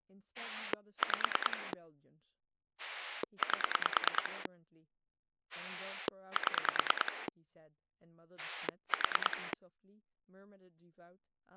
Pulse dialling, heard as a rotary dial, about 9 pulses a second, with speech in English. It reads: 5 8 7 4